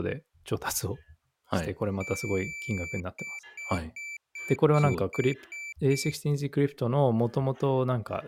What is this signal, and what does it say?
Beep code, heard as a piezo beeper, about 2350 Hz, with speech in Japanese. 1 long, 8 short. In AMI BIOS tables: display or retrace test failure.